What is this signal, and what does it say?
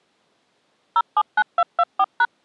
DTMF, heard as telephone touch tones, dialled by machine, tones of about 50 ms. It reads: 079224#